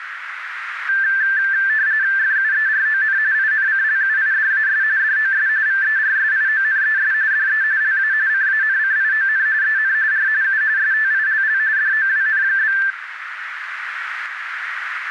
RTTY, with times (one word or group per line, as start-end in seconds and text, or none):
2.2-3.2 FUERON
3.3-4.8 INCLUIDAS
5.0-5.5 DOS
5.7-7.1 VERSIONES
7.3-7.6 DE
7.8-8.1 LA
8.3-9.5 CANCION
9.6-9.9 EN
10.1-10.3 R
10.4-10.6 U
10.8-11.6 STILL
11.8-12.8 DOWN?